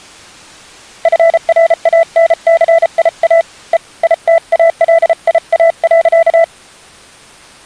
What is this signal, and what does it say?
Morse code, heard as a keyed tone, hand-sent with a paddle, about 33 wpm, 660 Hz. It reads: FRANCIA E ITALIA.